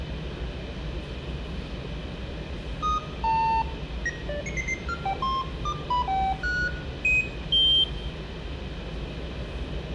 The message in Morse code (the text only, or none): none